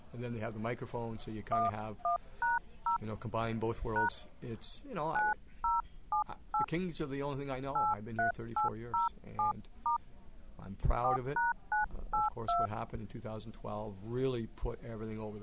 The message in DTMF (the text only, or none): 11#0 # 9078 83807* 4#982